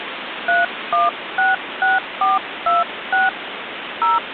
DTMF, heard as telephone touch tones, dialled by hand, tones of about 170 ms, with phone line noise. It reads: 3166426 0